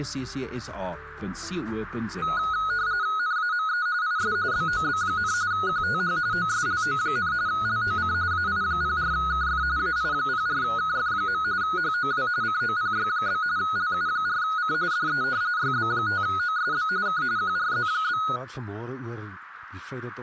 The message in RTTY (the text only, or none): NAME IS BOB, QTH OSLO, LOC AI04KF AI04KF. HOW COPY? LU4C DE YB5OSB K QRZ?